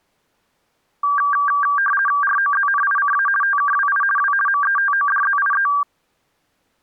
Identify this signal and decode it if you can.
RTTY (50 baud, 450 Hz shift), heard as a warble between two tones, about 1370 Hz centre. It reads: ROZNICA TKWI W METODZIE